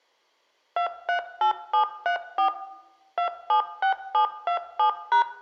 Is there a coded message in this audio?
Yes: DTMF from 0.8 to 5.2 s, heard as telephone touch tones, dialled by machine, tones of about 100 ms, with room echo. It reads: 238734 276727#